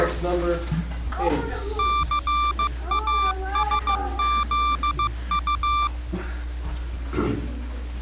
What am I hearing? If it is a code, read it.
Morse code, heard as a keyed tone, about 15 wpm, 1180 Hz. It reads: CASZU